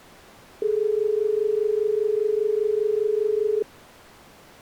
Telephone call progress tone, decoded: dial tone

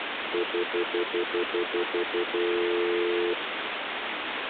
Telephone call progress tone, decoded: stutter dial tone

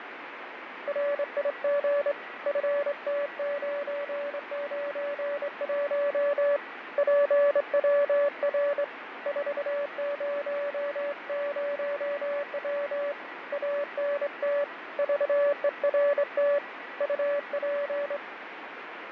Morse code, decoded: RIG FT991 PWR 400W ANT VERT UP

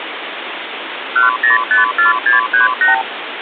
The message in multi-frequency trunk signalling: 1054638

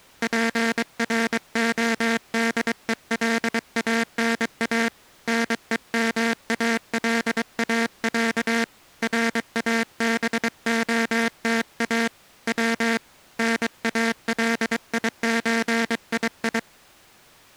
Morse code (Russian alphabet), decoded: ПРОДЕЛАНА НЕМАЛАЯ РАБОТА В НАЛИЧИИ

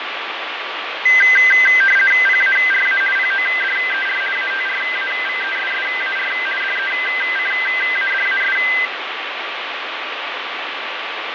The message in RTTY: PARA PODER ATRAVESSAR DECADAS

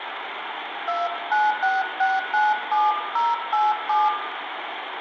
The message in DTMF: 296697087

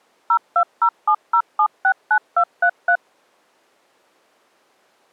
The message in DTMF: 02070769233

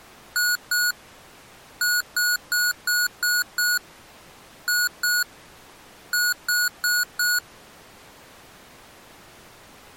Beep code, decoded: 2-6-2-4

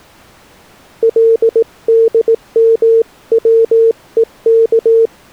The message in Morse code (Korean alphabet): 금방

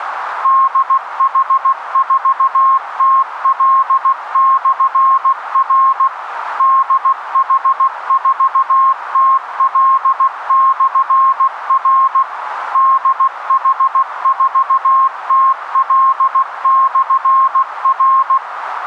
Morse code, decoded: DH4TL/R DH4TL/R DH4TL/R

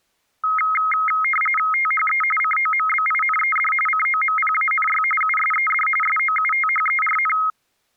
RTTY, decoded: THE COMBINED COMPANY USED SOUTHERN

